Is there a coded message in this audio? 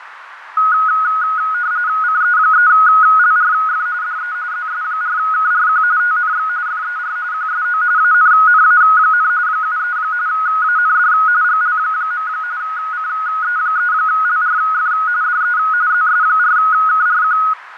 Yes: RTTY (45.45 baud, 170 Hz shift) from 0.6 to 17.5 s, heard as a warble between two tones, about 1360 Hz centre, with radio static, fading and a narrow filter. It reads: CE3LRF DE ZS4KRQ TNX FER QSO ANNA, 73 AND GL. CE3LRF DE ZS4KRQ